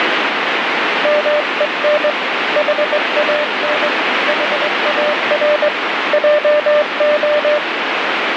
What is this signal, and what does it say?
Morse code, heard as a keyed tone, hand-sent with a straight key, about 21 wpm, 600 Hz, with heavy radio static. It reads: MEN HAN HAR JO